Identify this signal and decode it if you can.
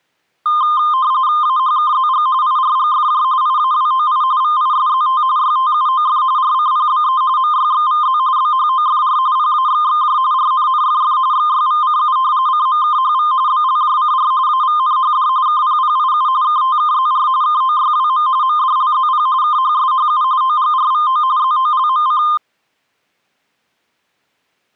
RTTY (45.45 baud, 170 Hz shift), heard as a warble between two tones, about 1130 Hz centre. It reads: AHKZG IRGFJ IAWOI VISZT YTUOF RCPBE MYXVZ BHOFR PAXXJ RNNFF XYVCU CMKHV BLJCR AVNHD KPPIU KTKZR KOYWM MDLZP KHSHU OGRVO ZOLMC